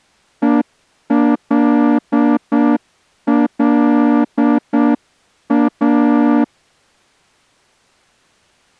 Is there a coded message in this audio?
Yes: Morse code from 0.4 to 6.5 s, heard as a horn, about 7 wpm. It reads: ELLA